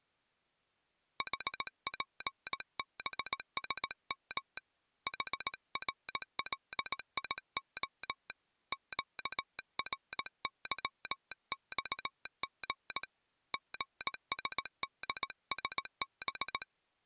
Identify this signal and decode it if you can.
Morse code, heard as a telegraph sounder, hand-sent with a paddle, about 18 wpm. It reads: HPBSM HRLIO QRYXG GSDSB